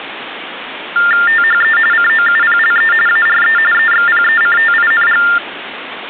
TTY/TDD text telephone tones (45.45 baud Baudot), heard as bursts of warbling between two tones, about 400 Hz shift, 1600 Hz centre, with phone line noise. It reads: THE COUPLE ARE EXPECTING